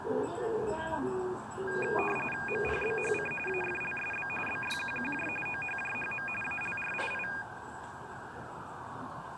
RTTY (45.45 baud, 850 Hz shift), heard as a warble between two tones, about 2050 Hz centre, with the noise of a residential street. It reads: MPBHC AFLSB BYQQJ OHJHM ALRII